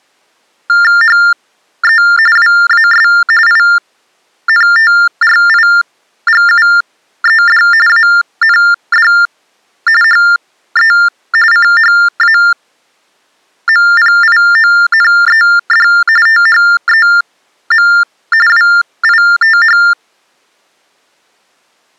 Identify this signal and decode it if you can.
TTY/TDD text telephone tones (45.45 baud Baudot), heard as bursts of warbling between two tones, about 400 Hz shift, 1600 Hz centre. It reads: HE WAS INTRIGUED AND HE CHAMPIONED THEM WITH